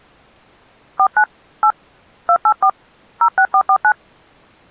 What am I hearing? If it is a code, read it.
DTMF, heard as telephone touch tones, dialled by hand, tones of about 70 ms. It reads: 49 8 284 06449